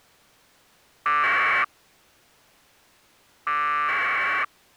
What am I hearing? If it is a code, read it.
Packet radio (AX.25, as in APRS), 1200 baud, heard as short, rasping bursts.